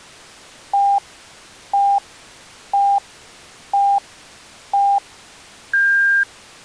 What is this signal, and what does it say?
Radio time signal (five pips and a higher one, as on Chinese radio), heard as pips.